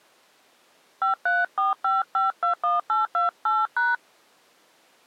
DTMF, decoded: 5345521828#

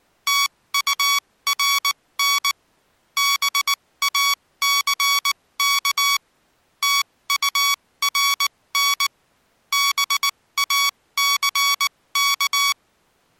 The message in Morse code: TURN BACK TURN BACK

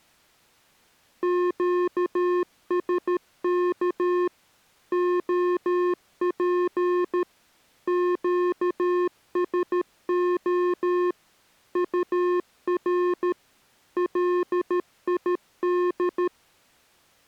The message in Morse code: QSK OP QSO UR LID

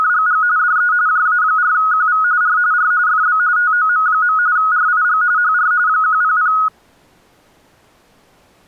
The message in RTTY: … DE JA4QV R R FB TOM. RIG HR 100

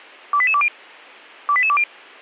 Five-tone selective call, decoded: 28820 28820

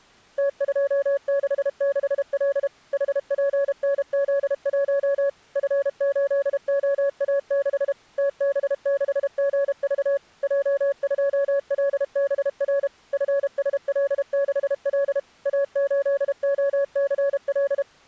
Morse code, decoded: T266L HPNZ1 F8OA6 TB6GV J2LBR FSL6L A8OCL

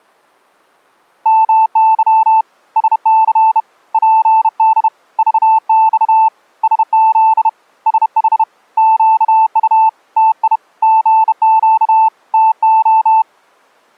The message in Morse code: MY SC PD VX SZ SH QU TI GQ TO

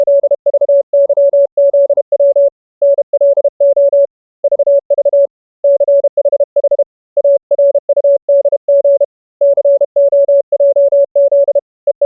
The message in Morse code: … NLO VV CHH ARUDG COJZ …

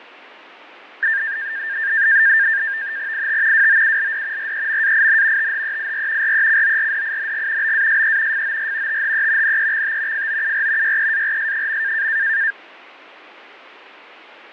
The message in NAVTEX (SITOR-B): IT WOULD REMAIN THEIR RECORDING BASE FOR THE NEXT FOUR YEARS.

